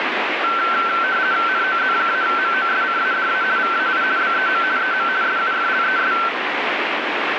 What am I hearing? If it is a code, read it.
RTTY (50 baud, 170 Hz shift), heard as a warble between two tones, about 1440 Hz centre, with radio static. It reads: NOZ-MOSCADA VAI BEM EM SUFLES